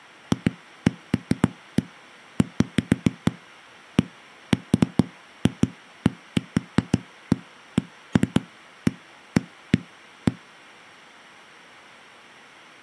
Irregular knocks on a wall. There is no code.